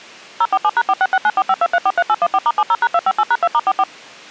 DTMF, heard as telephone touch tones, dialled by machine, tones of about 50 ms. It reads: 047#4669452343814*70#258#2*44